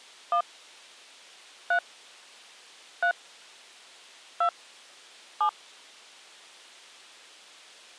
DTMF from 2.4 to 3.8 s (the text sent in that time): 3